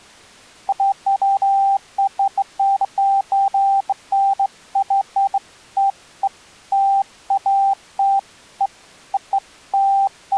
Beeps of irregular length. There is no code.